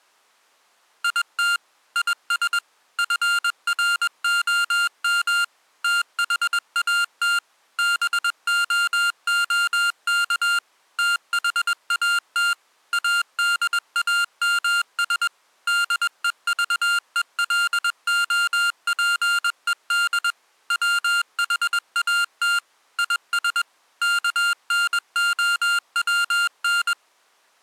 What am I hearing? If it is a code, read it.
Morse code, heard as electronic beeps, machine-sent, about 21 wpm, 1400 Hz. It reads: IT IS FROM THAT BOOK THAT ADAMS DEVELOPED WHAT IS KNOWN